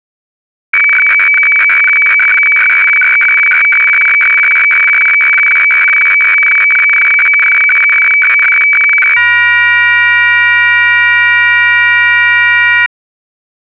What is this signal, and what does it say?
Weather fax (radiofax), 120 lines a minute, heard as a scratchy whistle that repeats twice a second.